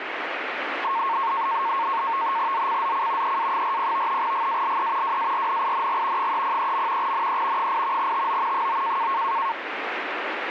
NAVTEX (SITOR-B), 100 baud, 170 Hz shift, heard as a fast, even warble, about 1000 Hz centre, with radio static. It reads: ZCZC EA40 GALE WARNING 303. NE 8 TO 9